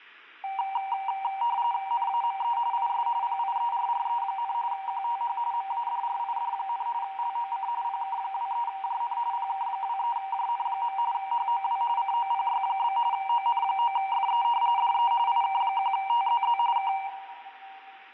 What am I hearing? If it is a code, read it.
RTTY (45.45 baud, 170 Hz shift), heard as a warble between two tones, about 860 Hz centre, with room echo. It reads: NAME IS PIERRE, QTH MADRID, LOC PK23JN PK23JN. HOW COPY? ON9FE DE IK1TZZ K